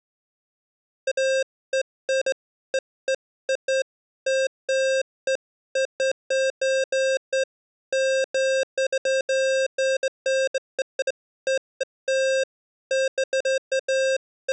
Beeps of irregular length. There is no code.